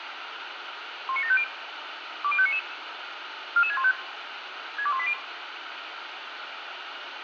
Five-tone selective call (ZVEI), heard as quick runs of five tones, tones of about 70 ms, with radio hiss. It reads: 19750 20599 44615 62180